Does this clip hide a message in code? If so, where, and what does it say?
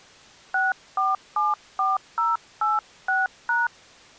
Yes: DTMF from 0.5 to 3.7 s, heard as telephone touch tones, dialled by hand, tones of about 180 ms. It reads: 6474086#